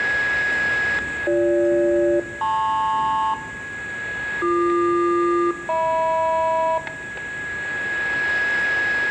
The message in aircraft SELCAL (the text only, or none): BG-LP BQ-HM